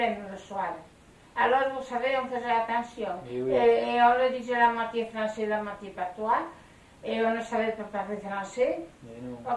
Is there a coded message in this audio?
No.